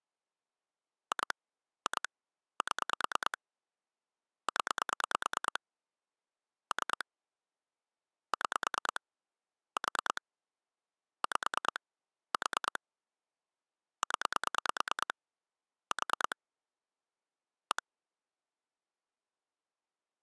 Pulse dialling, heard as clicks on a phone line, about 9 pulses a second. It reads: 2 2 7 0 3 6 4 5 4 0 4 1